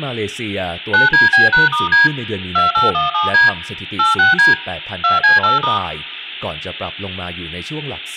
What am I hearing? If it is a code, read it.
DTMF, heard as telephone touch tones, dialled by machine, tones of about 160 ms, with speech in Thai. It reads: 9DB#*D 2817D 86D 2C8*